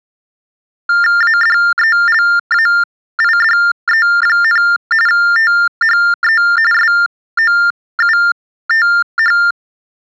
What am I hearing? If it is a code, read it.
TTY/TDD text telephone tones (45.45 baud Baudot), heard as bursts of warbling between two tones, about 400 Hz shift, 1600 Hz centre. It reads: ADELAIDE, THE SOUTH